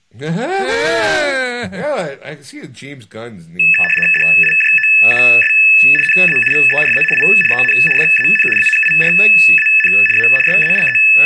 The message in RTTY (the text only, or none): DIJOUS NA VERA I EN JAN ANIRAN A …